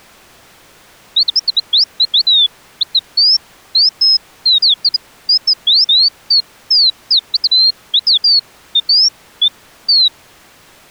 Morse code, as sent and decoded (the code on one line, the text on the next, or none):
none